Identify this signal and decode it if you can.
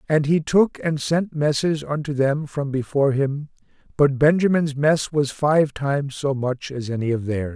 Speech in English. There is no code.